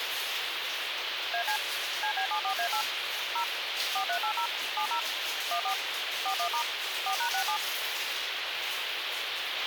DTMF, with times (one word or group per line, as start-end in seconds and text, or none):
1.3-1.6 AC
2.0-2.8 CB74A8
3.4-3.4 0
4.0-4.5 4380
4.8-5.0 70
5.5-5.7 14
6.3-6.6 41*
7.1-7.6 4#67